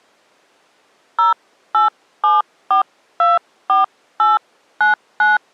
DTMF, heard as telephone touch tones, dialled by hand, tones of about 140 ms. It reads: 087424899